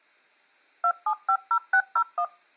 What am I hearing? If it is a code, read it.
DTMF, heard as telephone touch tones, dialled by machine, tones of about 70 ms. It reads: 2750601